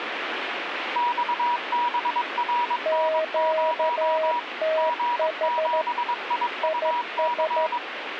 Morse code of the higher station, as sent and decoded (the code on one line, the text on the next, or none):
-..- -... .-. -. ----- / --. --... .. ..- -.-.
XBRN0 G7IUC